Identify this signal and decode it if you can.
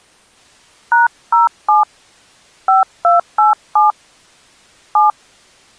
DTMF, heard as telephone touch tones, dialled by hand, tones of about 150 ms. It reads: #07 5287 7